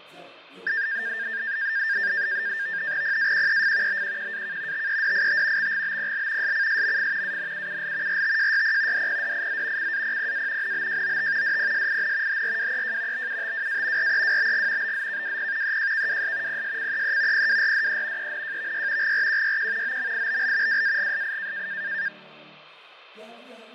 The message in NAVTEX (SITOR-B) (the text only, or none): PAQEF BQQAK TEDIT XGBPL SCSMF ANUUL RTJYP DPDIZ CAPPA NBJOT DPSIN HRWEJ BUTWA REWBG BZKWP EJKWS PSCEE PWRDE ENJVY GRQYQ OMIBL WAGSI